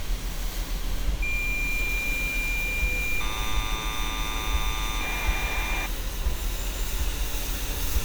Cassette data (Kansas City type), 1200 baud, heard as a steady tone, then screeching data, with street noise.